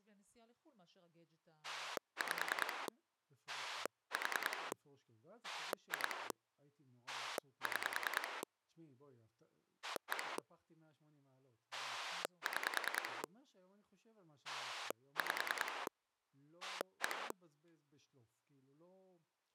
Pulse dialling, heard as a rotary dial, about 10 pulses a second, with speech in Hebrew. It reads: 5 4 2 6 1 6 5 1